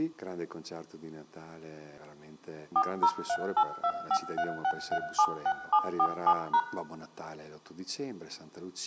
DTMF, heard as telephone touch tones, dialled by machine, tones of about 70 ms, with room echo. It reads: 40382536376747#